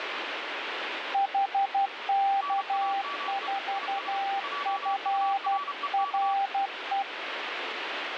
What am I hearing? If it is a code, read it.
Morse code, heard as two keyed tones, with radio static. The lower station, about 12 wpm, 790 Hz: HK4FRE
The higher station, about 31 wpm, 1140 Hz: NAME IS JUREK